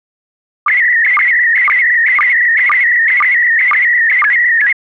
SSTV (slow-scan television), PD 120, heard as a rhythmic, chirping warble.